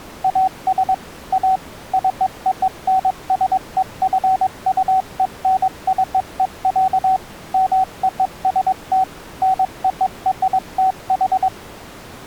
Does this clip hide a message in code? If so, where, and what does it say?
Yes: Morse code (American railroad code) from 0.2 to 11.5 s, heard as a keyed tone, machine-sent, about 760 Hz. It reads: AS A CONSEQUENCE, MOST NORTH